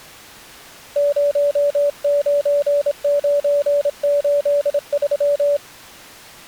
Morse code, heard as a keyed tone, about 27 wpm, 580 Hz. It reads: 09983